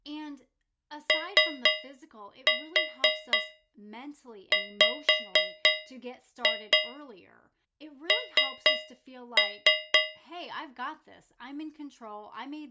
Tap code, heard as taps on a metal pipe, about 4 knocks a second, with speech in English. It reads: OWN